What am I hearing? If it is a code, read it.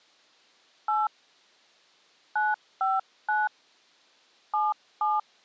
DTMF, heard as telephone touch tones, dialled by hand, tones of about 190 ms. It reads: 8 959 77